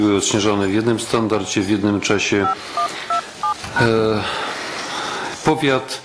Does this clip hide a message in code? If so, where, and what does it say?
Yes: DTMF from 2.4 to 3.9 s, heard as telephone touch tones, dialled by machine, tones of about 100 ms. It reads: 5127#